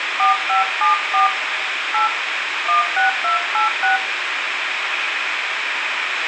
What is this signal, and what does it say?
DTMF, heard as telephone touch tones, dialled by hand, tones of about 130 ms, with radio hiss, a squelch burst at the end and room echo. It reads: 4574 8 16286